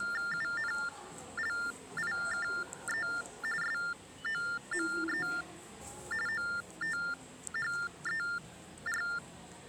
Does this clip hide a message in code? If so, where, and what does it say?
Yes: TTY/TDD text telephone tones (45.45 baud Baudot) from 0.0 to 9.2 s, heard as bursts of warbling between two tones, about 400 Hz shift, 1600 Hz centre, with the noise of a subway station. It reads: UNLIKE SOME OTHER